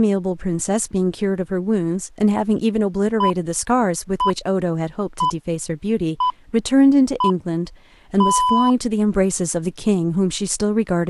Radio time signal (six pips, as the Greenwich Time Signal), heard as pips, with speech in English.